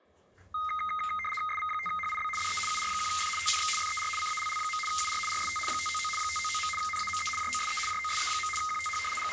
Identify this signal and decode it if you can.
RTTY (75 baud, 850 Hz shift), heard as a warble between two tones, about 1650 Hz centre, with the noise of a restroom. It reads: SV5HIB DE UR1F TNX FER CALL. UR RST 599 599. NAME JOSE JOSE. QTH …